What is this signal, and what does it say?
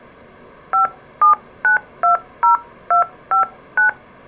DTMF, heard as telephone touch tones, dialled by hand, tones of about 120 ms. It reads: 57920259